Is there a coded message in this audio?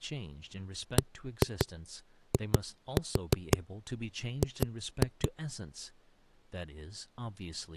Yes: tap code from 1.0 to 5.3 s, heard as knocks on a wall, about 5 knocks a second, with speech in English. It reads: BIG